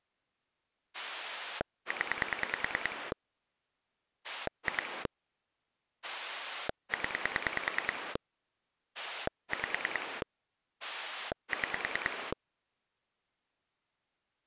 Pulse dialling, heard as a rotary dial, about 10 pulses a second. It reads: 0 2 0 5 6